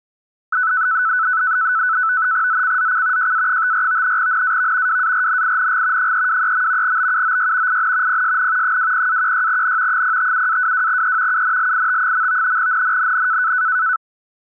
NAVTEX (SITOR-B), 100 baud, 170 Hz shift, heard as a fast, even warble, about 1400 Hz centre. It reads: ZCZC JA54 NAV WARNING 323. BUOY IN PSN 20-16N 057-22E UNLIT. NNNN